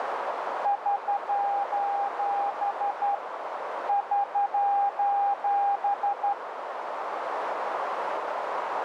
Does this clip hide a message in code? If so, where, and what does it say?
Yes: Morse code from 0.6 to 6.4 s, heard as a keyed tone, hand-sent with a straight key, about 12 wpm, 800 Hz, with radio static and a narrow filter. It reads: <SOS> <SOS>